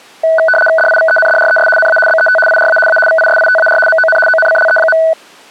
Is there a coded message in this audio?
Yes: RTTY (75 baud, 850 Hz shift) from 0.2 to 5.1 s, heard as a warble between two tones, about 1070 Hz centre. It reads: DIVENDRES NA BET IRA A VISITAR MON ONCLE.